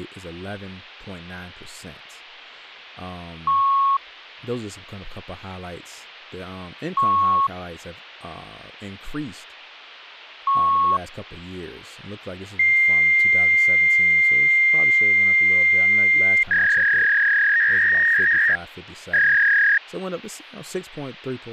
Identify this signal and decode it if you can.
Fax machine handshake, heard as beeps, a long tone and a warble, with hum and speech in English.